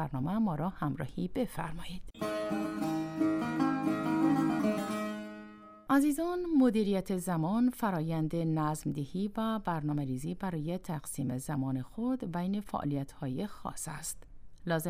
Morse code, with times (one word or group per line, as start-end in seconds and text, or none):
none